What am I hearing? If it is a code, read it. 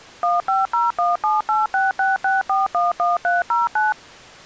DTMF, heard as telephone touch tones, dialled by machine, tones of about 170 ms. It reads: 150178666411309